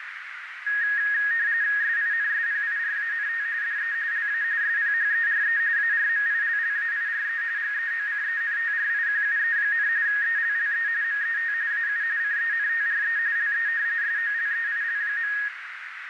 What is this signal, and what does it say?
RTTY (45.45 baud, 170 Hz shift), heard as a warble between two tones, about 1750 Hz centre, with radio static and a narrow filter. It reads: SINSPIRANT DE LA SPHERE ARMILLAIRE GEOCENTRIQUE, ELLE MET AU CENTRE LE SOLEIL.